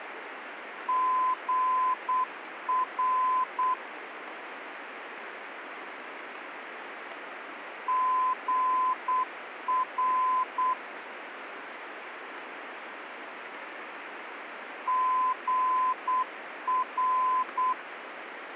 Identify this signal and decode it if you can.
Morse code, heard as a keyed tone, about 8 wpm, 1020 Hz, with radio static. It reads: GR GR GR